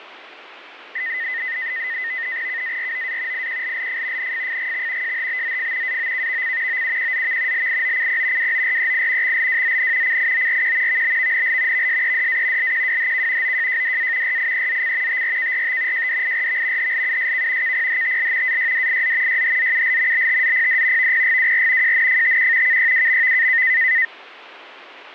NAVTEX (SITOR-B), 100 baud, 170 Hz shift, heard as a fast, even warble, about 1950 Hz centre, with radio static and fading. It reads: KAROA IQLLF NFFGX JHBZF AOKVC OUQZV LIOCP WOREI XLWZN CIORQ VBVNL VSEDA LQWHK OJJDA RIEZC TRKRT JDIRV HLUSK KPHTL AYDIZ YHZUL BTZPD VPGWR JNFTQ KYWMV